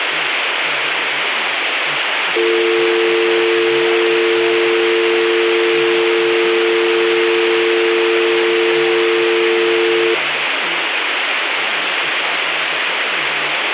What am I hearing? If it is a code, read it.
Telephone call progress tone (North American or UK plan), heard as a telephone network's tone, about 350, 450 Hz, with phone line noise and speech in English. Dial tone.